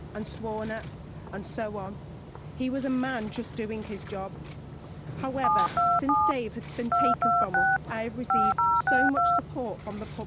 DTMF, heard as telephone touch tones, dialled by hand, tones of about 220 ms. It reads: 727 226 5062